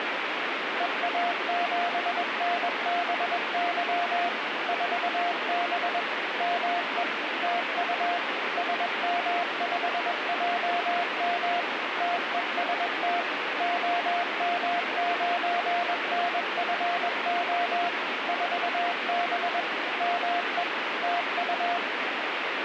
Morse code, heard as a keyed tone, machine-sent, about 21 wpm, 700 Hz, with radio static. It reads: EA7NBY 4B ME TU SM5JM TEST OM9NFO 4B ME TU